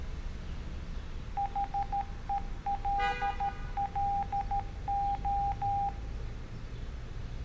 Morse code, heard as a keyed tone, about 13 wpm, 800 Hz, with room echo and street noise. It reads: HELLO